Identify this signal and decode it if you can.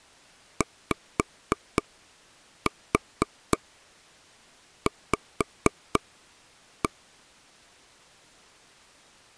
Tap code, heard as taps on a table, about 4 knocks a second. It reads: YV